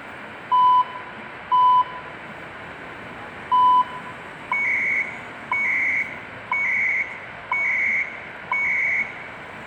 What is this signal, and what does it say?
Radio time signal (CHU, Canada), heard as beeps and data bursts, one a second, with radio static, room echo and street noise.